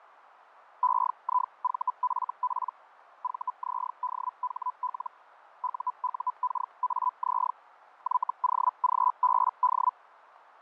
Hellschreiber (Feld-Hell, 122.5 baud), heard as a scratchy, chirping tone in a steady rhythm, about 1000 Hz, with radio static and fading. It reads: EIVFP VZDHL UUKAZ YOGBD